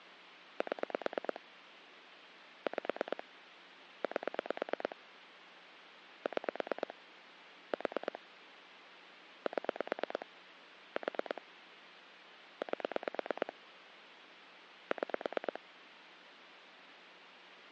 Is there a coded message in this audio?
Yes: pulse dialling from 0.6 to 15.6 s, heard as clicks on a phone line, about 9 pulses a second, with phone line noise. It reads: 7 5 8 6 4 7 4 8 6